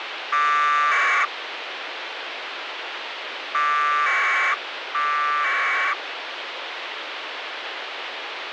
Packet radio (AX.25, as in APRS), 1200 baud, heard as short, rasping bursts, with radio hiss.